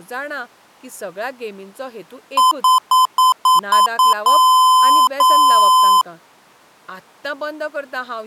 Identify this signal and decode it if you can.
Beep code, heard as beeps from a small speaker, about 1020 Hz, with speech in Goan Konkani. 7 short, 2 long.